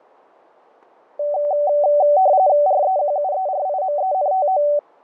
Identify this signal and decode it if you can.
RTTY (45.45 baud, 170 Hz shift), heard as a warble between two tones, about 670 Hz centre, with fading. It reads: REQUERIMENTO